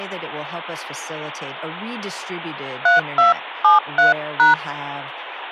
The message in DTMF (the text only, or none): 3273#